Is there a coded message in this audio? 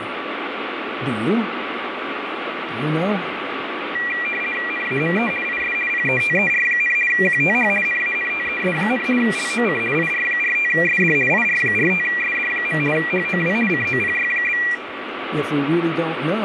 Yes: RTTY (50 baud, 450 Hz shift) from 3.9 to 14.7 s, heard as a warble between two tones, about 2150 Hz centre, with radio static. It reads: NAME IS PETER, QTH NANTES, LOC IR45SD IR45SD. HOW COPY?